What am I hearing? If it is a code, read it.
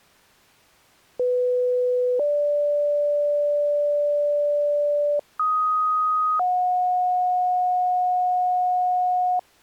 Two-tone page, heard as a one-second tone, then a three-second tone, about 500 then 580 Hz, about 1250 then 730 Hz.